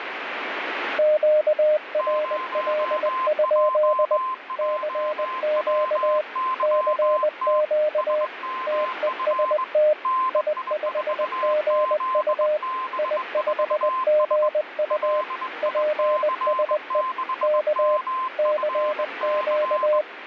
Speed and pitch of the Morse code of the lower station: 20 wpm, 610 Hz

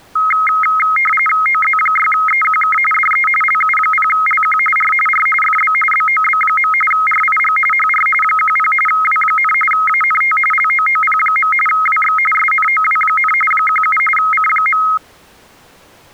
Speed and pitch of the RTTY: 45.45 baud, 850 Hz shift, 1700 Hz centre

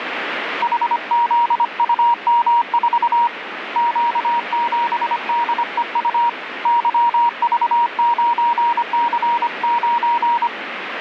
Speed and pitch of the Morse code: 25 wpm, 950 Hz

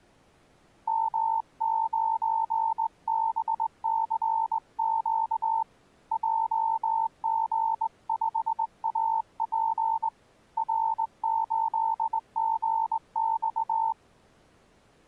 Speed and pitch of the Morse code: 20 wpm, 900 Hz

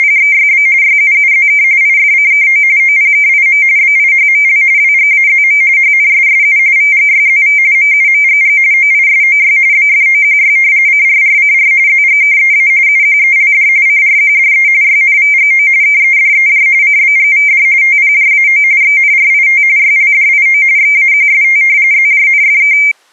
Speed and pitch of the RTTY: 45.45 baud, 170 Hz shift, 2200 Hz centre

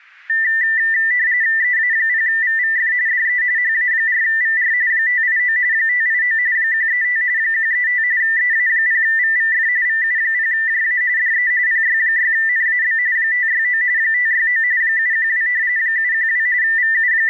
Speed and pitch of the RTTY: 45.45 baud, 170 Hz shift, 1900 Hz centre

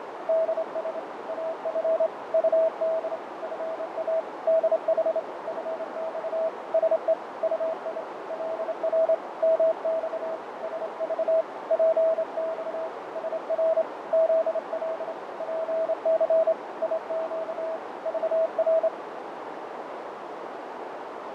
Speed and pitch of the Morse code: 27 wpm, 650 Hz

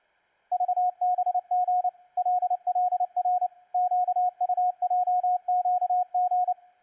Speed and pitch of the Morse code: 29 wpm, 720 Hz

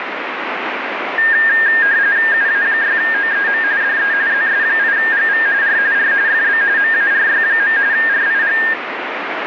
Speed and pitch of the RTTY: 45.45 baud, 170 Hz shift, 1700 Hz centre

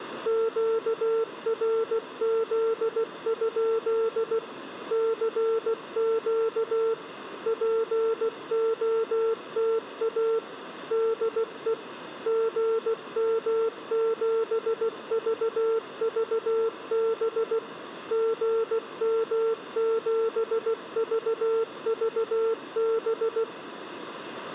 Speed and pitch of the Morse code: 16 wpm, 450 Hz

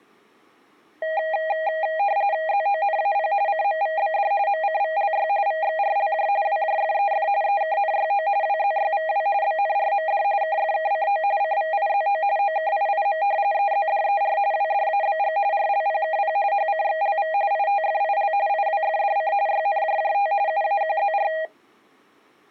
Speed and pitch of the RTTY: 45.45 baud, 170 Hz shift, 720 Hz centre

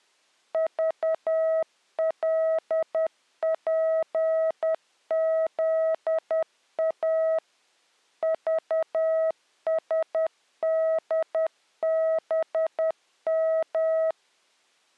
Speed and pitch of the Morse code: 10 wpm, 640 Hz

